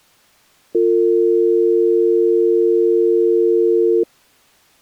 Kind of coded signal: telephone call progress tone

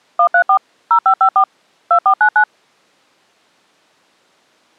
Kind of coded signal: DTMF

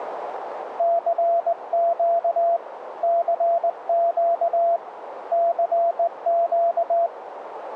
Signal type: Morse code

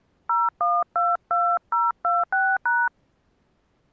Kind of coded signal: DTMF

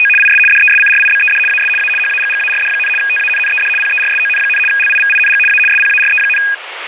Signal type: RTTY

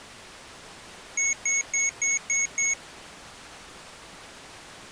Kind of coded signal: beep code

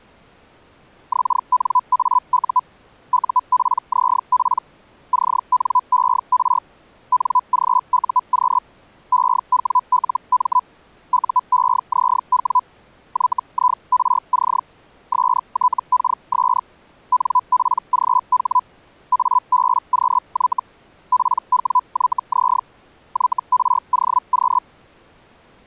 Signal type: Hellschreiber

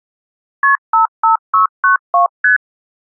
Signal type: multi-frequency trunk signalling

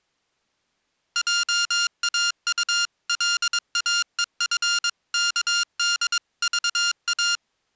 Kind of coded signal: Morse code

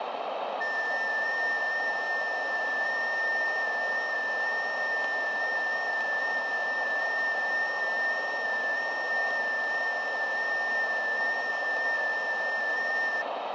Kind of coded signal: FT8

